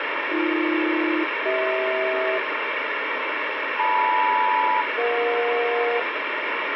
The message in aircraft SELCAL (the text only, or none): AB-CH LM-EJ